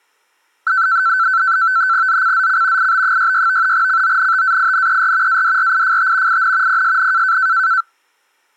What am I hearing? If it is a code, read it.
NAVTEX (SITOR-B), 100 baud, 170 Hz shift, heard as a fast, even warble, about 1430 Hz centre. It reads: ZCZC IB66 CONTAINER ADRIFT IN PSN